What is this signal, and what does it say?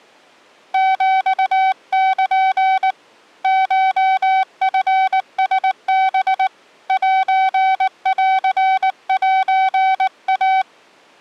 Morse code (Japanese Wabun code), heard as a keyed tone, hand-sent with a paddle, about 19 wpm, 760 Hz. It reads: ヒル コチラハ センセイ